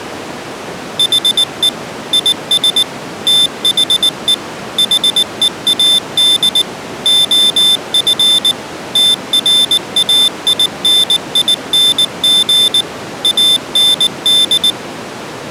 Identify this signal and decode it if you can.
Morse code, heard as a high beeper, machine-sent, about 19 wpm, 3550 Hz. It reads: HE IS THE HEAD OF TRAINING AND